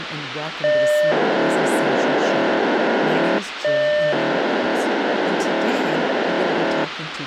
POCSAG pager data (1200 baud), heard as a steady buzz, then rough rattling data, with radio hiss and speech in English.